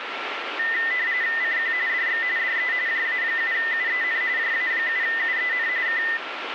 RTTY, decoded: CQ DX DE JA7UEN JA7UEN K

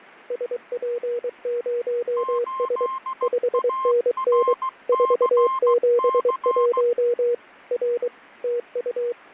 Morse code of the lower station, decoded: SP0S 5NN 471 R TU

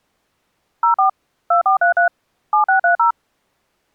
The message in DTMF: 04 2433 7630

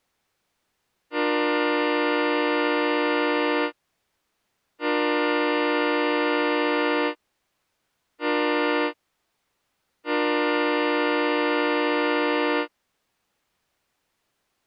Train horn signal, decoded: 2 long, 1 short, 1 long

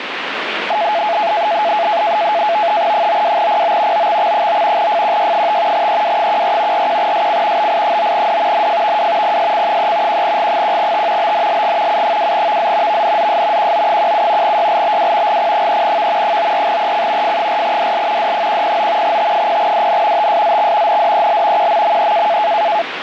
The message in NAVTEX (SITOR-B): 92PO OXX9 FQY5 EW14 41SC BI9D NFVW PSC3 1G1T BNLG U2VZ VNZS QO17 YLBW GP3V 94EC F4DL D109 T0DN TSZX NDEL QMME

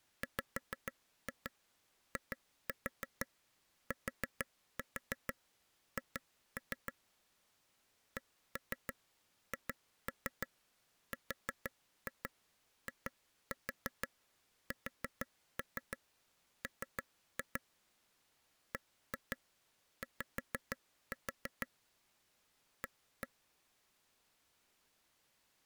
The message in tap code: WITH CHRISM BY A

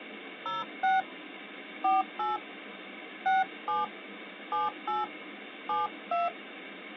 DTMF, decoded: 06 48 67 78 72

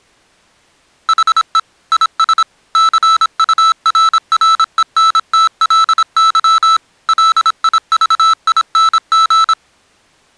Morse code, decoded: HE IS CURRENTLY LIVING

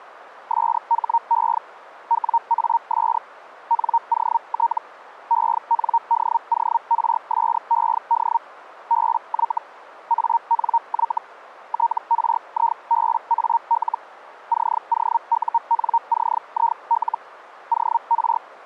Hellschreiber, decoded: SHE WAS NOT ENDORSED BY ANY TRIBAL COUNCIL OR

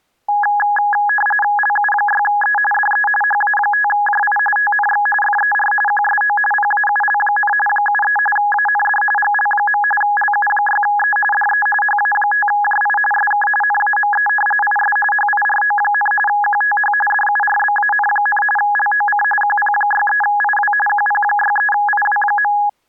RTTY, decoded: LU6E DE HA5JI TNX FER QSO PAUL, 73 AND GL. LU6E DE HA5JI SK NAME IS HIRO, QTH DURBAN, LOC QP63IW QP63IW.

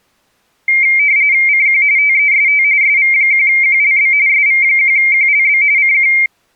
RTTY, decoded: CQ TEST SV1QLB SV1QLB CQ

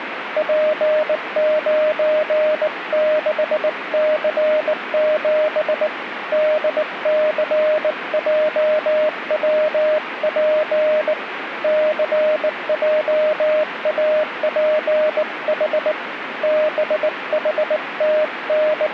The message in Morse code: P96C7 DCJWP CJAPH …

